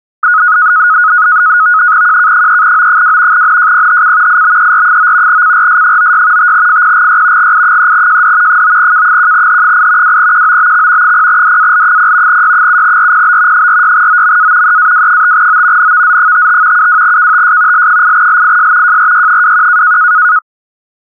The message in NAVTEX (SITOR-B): QK3O2 NJPHC IBER9 CRS96 5FPGY GI3JD 9K1H8 2QOBX 0DAL0 Y7RPB 46OMA EAW5O NVZ55 72KTS L8LIS JRY21

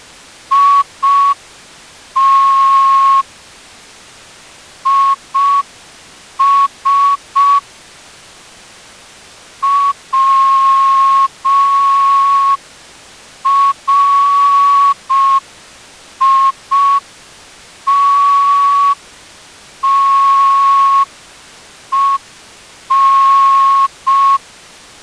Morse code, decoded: IT IS WRITTEN

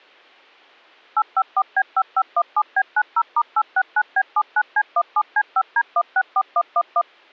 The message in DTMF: 854B5517B90*869B79C17C5D164111

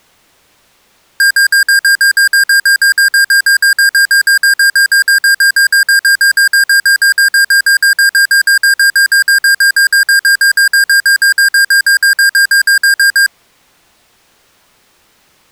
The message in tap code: none

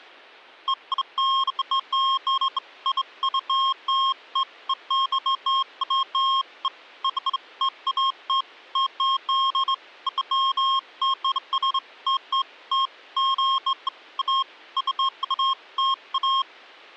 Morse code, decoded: none

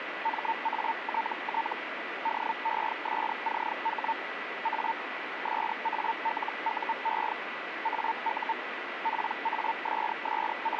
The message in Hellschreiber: MATT DESCH A SALUE AU …

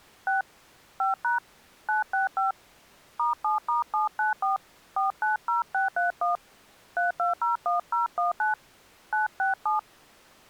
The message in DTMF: 6 5# 965 *7*794 490631 3201019 967

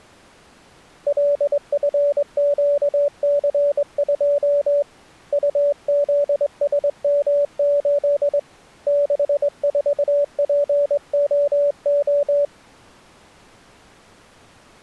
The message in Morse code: LFQC2 UZSM8 64POO

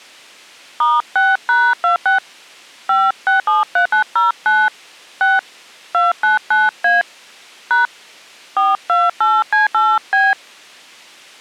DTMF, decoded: *6#26 5673909 6 299A # 428C8B

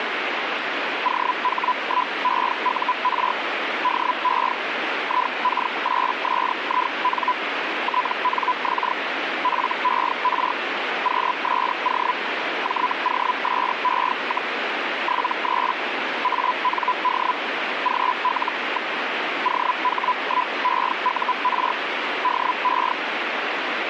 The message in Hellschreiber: OH1EUR DE IK8SIN TNX FER QSO JOSE, 73 AND GL. OH1EUR DE

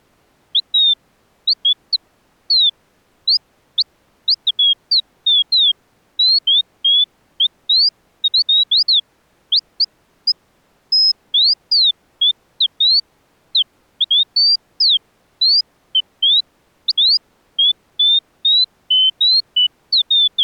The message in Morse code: none

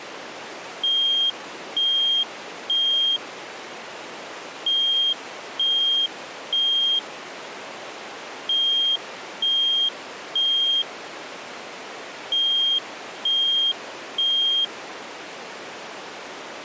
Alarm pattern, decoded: temporal three

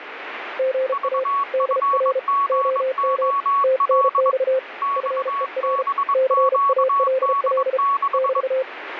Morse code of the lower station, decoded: GA DR OM TNX FER CALL <BT>

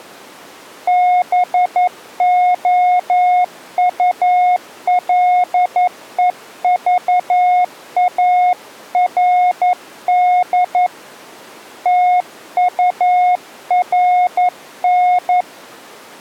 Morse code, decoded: BOULEVARD TURN

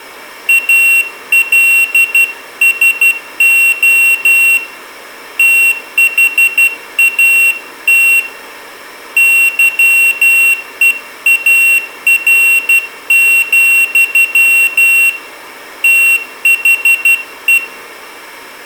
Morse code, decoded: ALSO THAT YEAR, THE

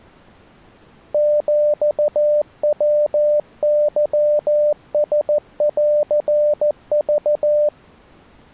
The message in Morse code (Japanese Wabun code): ヒヤケランク

